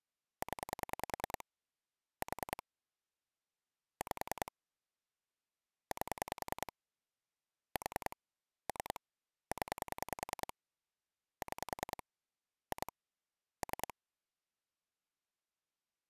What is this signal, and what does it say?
Pulse dialling, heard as clicks on a phone line, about 10 pulses a second. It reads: 0 4 5 8 4 3 0 6 2 3